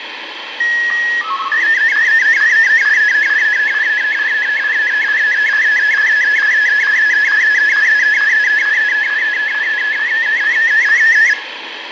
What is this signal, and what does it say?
SSTV (slow-scan television), Martin M1, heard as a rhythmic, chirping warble, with radio static and room echo.